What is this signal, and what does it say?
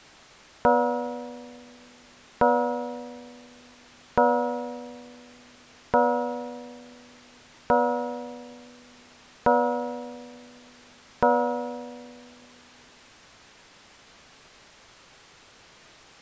Clock strike, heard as a bell. 7. Seven o'clock.